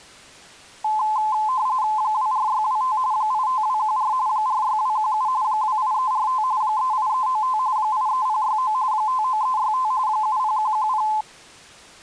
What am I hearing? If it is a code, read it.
RTTY (45.45 baud, 170 Hz shift), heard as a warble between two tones, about 950 Hz centre. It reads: 24625 85214 46217 28345 38395 83069 59365 70110